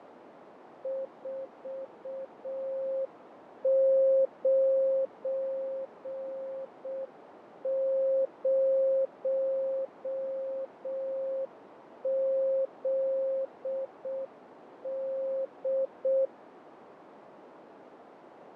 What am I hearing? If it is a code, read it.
Morse code, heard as a keyed tone, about 6 wpm, 540 Hz, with radio static, fading and a narrow filter. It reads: 490ZD